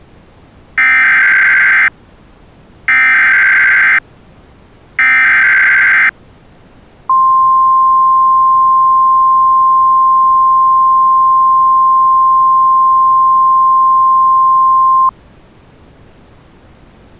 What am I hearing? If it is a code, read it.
Emergency Alert System (SAME) tones (header bursts, then the 1050 Hz attention tone), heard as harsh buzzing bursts, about 520.83 baud.